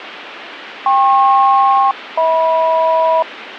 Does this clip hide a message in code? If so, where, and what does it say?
Yes: aircraft SELCAL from 0.9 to 3.2 s, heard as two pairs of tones, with radio static. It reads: KP-HM